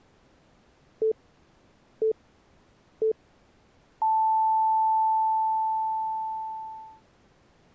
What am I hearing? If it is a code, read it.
Radio time signal (three low pips and a long one an octave up, as on NHK), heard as pips.